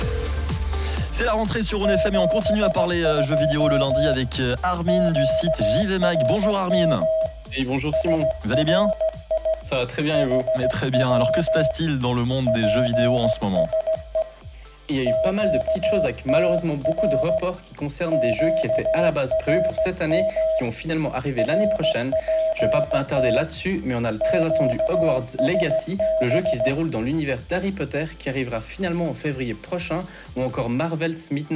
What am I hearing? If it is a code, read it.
Morse code, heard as a keyed tone, hand-sent with a straight key, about 16 wpm, 640 Hz, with room echo. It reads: 72 QRM SRI HW PSE QTR QRM RPT QSB